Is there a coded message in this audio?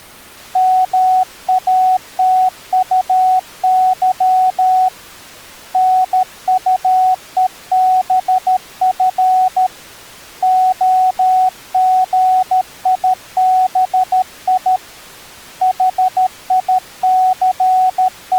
Yes: Morse code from 0.5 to 18.4 s, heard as a keyed tone, hand-sent with a paddle, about 13 wpm, 740 Hz. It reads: MATUY NUEBF OGIBI …